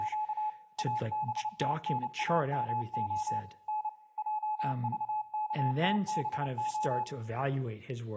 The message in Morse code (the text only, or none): … ABTNAMO N JVKTBO